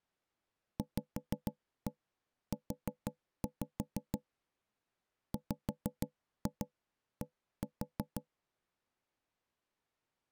Tap code, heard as knocks on wood, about 6 knocks a second. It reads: VU WD